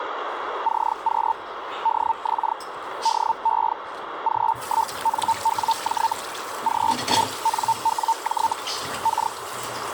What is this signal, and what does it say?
Hellschreiber (Feld-Hell, 122.5 baud), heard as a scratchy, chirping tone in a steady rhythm, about 900 Hz, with radio static and kitchen noise. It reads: CQ DX DE G1NWJ G1NWJ K